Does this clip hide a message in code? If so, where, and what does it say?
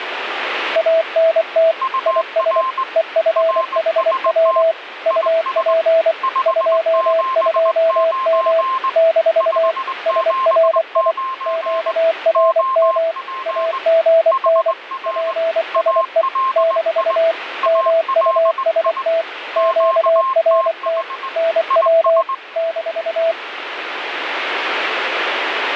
Yes: Morse code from 0.7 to 23.4 s, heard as two keyed tones, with radio static. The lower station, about 24 wpm, 660 Hz: ANT IS EFHW UP 22M - SRI QRM AGN PSE - MUST QRT NW -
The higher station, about 20 wpm, 1050 Hz: UR RST IS 579 579 OP HR ALI ALI QTH IS